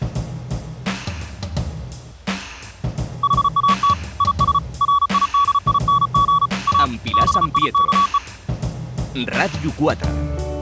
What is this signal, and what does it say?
Morse code, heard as a keyed tone, hand-sent with a paddle, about 34 wpm, 1130 Hz. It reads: HAT IS RIDING A BIKE